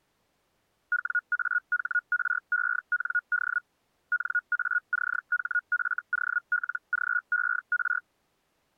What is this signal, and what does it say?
Hellschreiber (Feld-Hell, 122.5 baud), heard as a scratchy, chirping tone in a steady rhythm, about 1440 Hz. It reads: WAHREND NACHFOLGER